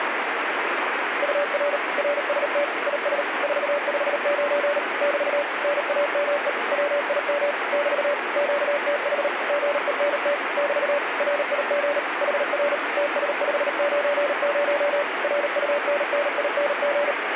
Morse code, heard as a keyed tone, machine-sent, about 38 wpm, 580 Hz, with radio static. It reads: UR RST IS 459 <BT> NAME WIM <BT> QTH GENT <BT> RIG HR TS590 RUNNING